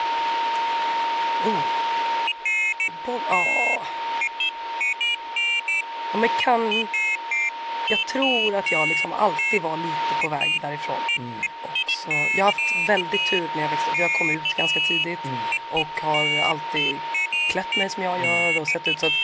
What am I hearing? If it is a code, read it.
Pairs of high tones at irregular times, with radio static, a steady whistle near 920 Hz and speech in Swedish. There is no code.